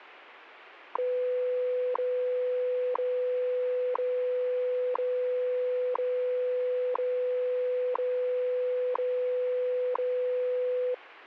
Radio time signal (WWV, Colorado), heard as ticks, one a second.